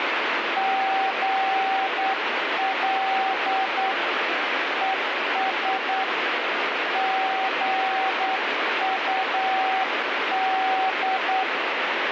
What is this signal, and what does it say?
Morse code, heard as a keyed tone, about 9 wpm, 770 Hz, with heavy radio static. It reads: GL ES GUD